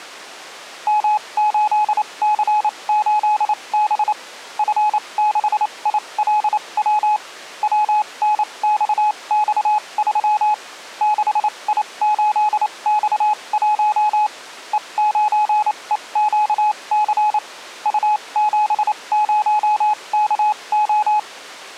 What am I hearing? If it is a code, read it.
Morse code, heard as a keyed tone, machine-sent, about 28 wpm, spaced as for 23 wpm, 850 Hz. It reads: M8C8B F6ILW WNXX3 6I8X1 E9EQC U70KO